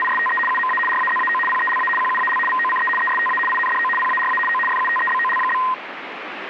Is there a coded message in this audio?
Yes: RTTY (75 baud, 850 Hz shift) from 0.0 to 5.7 s, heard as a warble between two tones, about 1450 Hz centre, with radio static. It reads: … UMA RAZAO PELA QUAL VOCE ESTA INDO PARA O FUTEBOL?